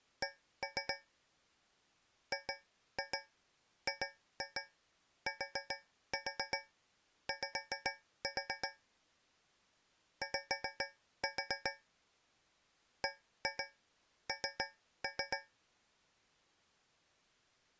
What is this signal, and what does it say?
Tap code, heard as taps on a metal pipe, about 7 knocks a second. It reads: C GGTY Y BN